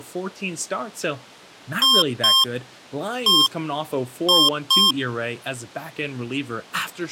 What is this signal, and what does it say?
Beep code, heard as beeps from a small speaker, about 1060 Hz, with speech in English. 2-1-2.